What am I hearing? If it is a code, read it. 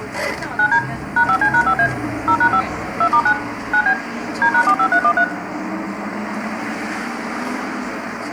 DTMF, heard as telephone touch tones, dialled by machine, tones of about 80 ms, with room echo and the noise inside a bus. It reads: 9D #5C#5A 0#5 2*9 9B D#45313